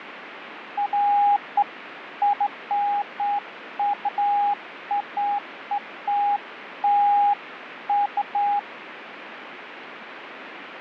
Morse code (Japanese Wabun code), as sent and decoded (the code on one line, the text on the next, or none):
none